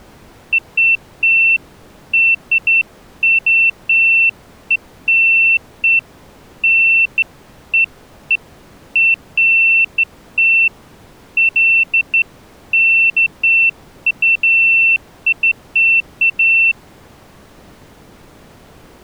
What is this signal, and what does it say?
Beeps of irregular length. There is no code.